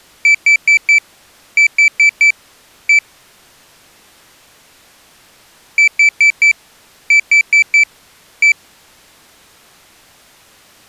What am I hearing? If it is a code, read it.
Beep code, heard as a piezo beeper, played twice, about 2300 Hz. 4-4-1. In Phoenix BIOS tables: serial port failure.